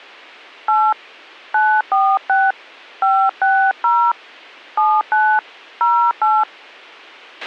DTMF, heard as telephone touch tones, dialled by hand, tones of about 260 ms, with a squelch burst at the end. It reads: 8 946 560 79 08